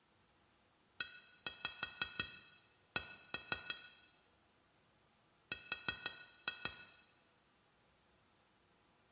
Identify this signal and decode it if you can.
Tap code, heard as taps on glass, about 6 knocks a second, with room echo. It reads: EC R